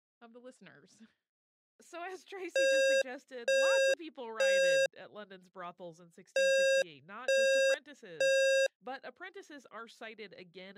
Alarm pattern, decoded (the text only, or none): temporal three